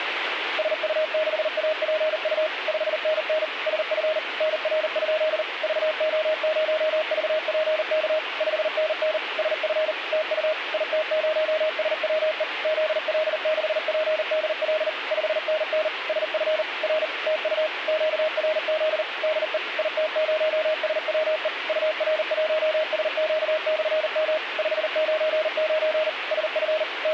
Morse code, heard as a keyed tone, machine-sent, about 39 wpm, 620 Hz, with radio static. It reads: SU6APU 5NN SF NR? VO0VPK 5NN SF TU IT0SWE ZL6PDL 5NN SF R TU QRZ DE IT0SWE UR1SQ/M 599 SF …